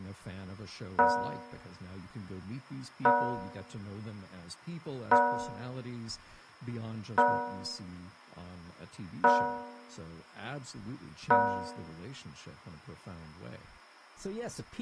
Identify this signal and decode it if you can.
Clock strike, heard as a bell, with room echo and speech in English. 6. Six o'clock.